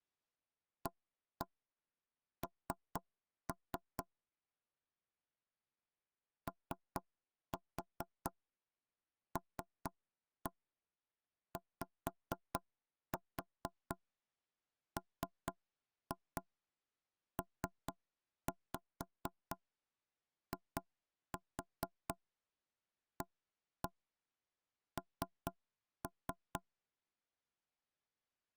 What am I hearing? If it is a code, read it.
Tap code, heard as knocks on wood, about 4 knocks a second. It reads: AN OLYMPIAN